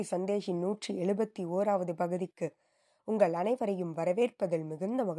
Speech in Tamil. There is no code.